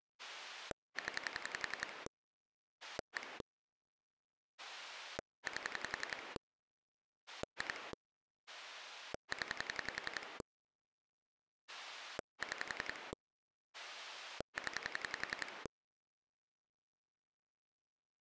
Pulse dialling, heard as a rotary dial, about 11 pulses a second. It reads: 0 1 8 2 0 6 0